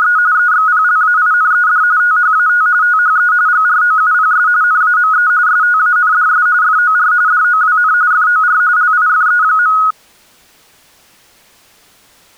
RTTY (45.45 baud, 170 Hz shift), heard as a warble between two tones, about 1360 Hz centre. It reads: … EXPLAINED THAT THE GROUPS NAME STANDS FOR DOWN FOR LIFE.